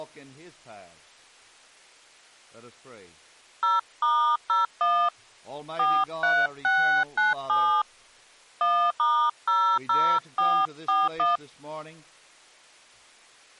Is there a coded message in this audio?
Yes: DTMF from 3.6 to 11.4 s, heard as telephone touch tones, dialled by hand, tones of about 270 ms. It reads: 0*01 43697 1*00441